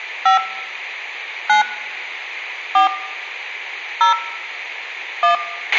DTMF, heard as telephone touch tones, dialled by hand, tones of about 120 ms, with a squelch burst at the end and room echo. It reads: 5 9 4 0 1